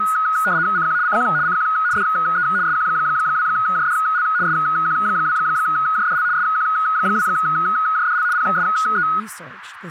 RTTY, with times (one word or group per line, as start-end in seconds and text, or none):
0.8-1.0 CQ
1.1-1.2 CQ
1.5-1.7 CQ
2.0-2.5 DE
2.7-4.2 SQ2JDL
4.5-6.2 SQ2JDL
6.4-8.2 SQ2JDL
8.3-9.1 PSE